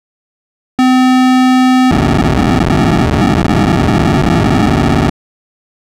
POCSAG pager data (512 baud), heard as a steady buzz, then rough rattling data.